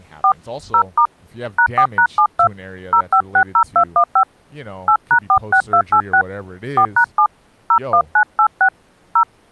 DTMF, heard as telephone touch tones, dialled by hand, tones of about 80 ms, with speech in English. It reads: 4 0* #4#72 0560215 8#46286 4#7 01986 0